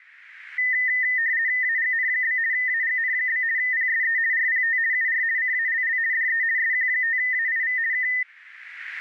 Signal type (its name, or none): RTTY